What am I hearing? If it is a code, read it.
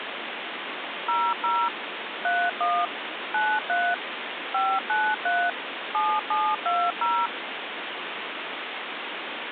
DTMF, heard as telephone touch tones, dialled by machine, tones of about 250 ms, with phone line noise. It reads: 00 31 93 593 7720